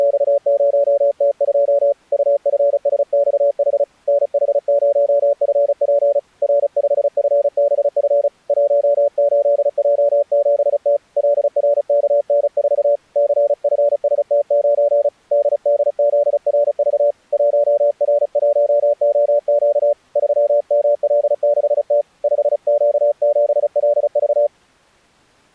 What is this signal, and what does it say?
Morse code, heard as a keyed tone, hand-sent with a paddle, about 35 wpm, 580 Hz. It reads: … UFSXH NH0FP R5FBF 18J7T LRKN4 CFST9 DDZRV 1R1OQ 3ML6T 5Q7LV